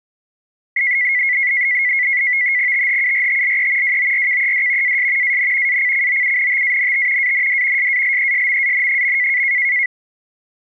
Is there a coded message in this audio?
Yes: NAVTEX (SITOR-B), 100 baud, 170 Hz shift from 0.8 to 9.9 s, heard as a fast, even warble, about 2050 Hz centre. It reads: THURTLE WORKED AS AN ACCOUNTANT AND SALESMAN.